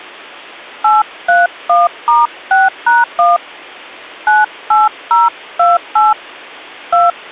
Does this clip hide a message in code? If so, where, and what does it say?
Yes: DTMF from 0.8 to 7.1 s, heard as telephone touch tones, dialled by hand, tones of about 180 ms. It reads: 831*6#1 98028 2